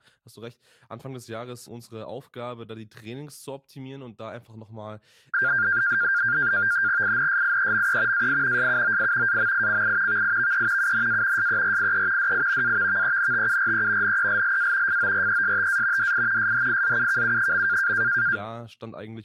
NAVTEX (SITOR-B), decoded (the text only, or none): INSIEME AI SUOI AMICI VIVE UNA SERIE DI AVVENTURE NELLA FORESTA DI SHIZUKU.